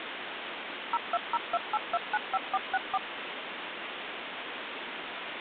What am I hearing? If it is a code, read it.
DTMF, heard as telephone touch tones, dialled by machine, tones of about 40 ms, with phone line noise. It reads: 02028295464